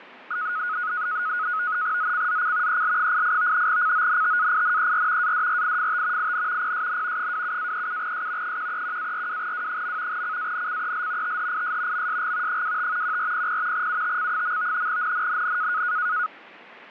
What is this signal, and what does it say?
NAVTEX (SITOR-B), 100 baud, 170 Hz shift, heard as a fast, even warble, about 1360 Hz centre, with radio static and fading. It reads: ZCZC EL88 CONTAINER ADRIFT IN PSN 27-37S 131-42W. CANCEL THIS MSG 25 1400 UTC. NNNN